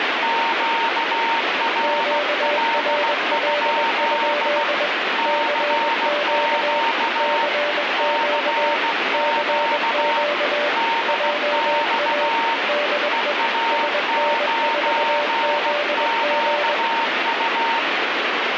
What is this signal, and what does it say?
Morse code, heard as two keyed tones, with heavy radio static. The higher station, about 16 wpm, 920 Hz: QRL? CQ CQ DX EA9QU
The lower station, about 21 wpm, 590 Hz: QRL? CQ CQ CQ JA DE SN4ZG